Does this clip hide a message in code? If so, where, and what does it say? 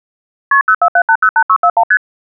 Yes: multi-frequency trunk signalling (R1, as on North American trunks) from 0.5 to 2.0 s, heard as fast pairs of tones, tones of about 70 ms. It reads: KP 047808641 ST